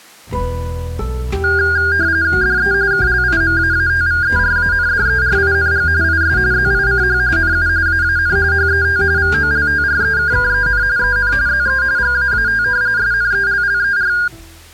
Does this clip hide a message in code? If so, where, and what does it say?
Yes: RTTY (45.45 baud, 170 Hz shift) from 1.4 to 14.3 s, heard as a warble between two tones, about 1500 Hz centre. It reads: DE KLIMAATVERANDERING IS ZICH NU AAN HET VOLTREKKEN EN ZE GAAT SNELLER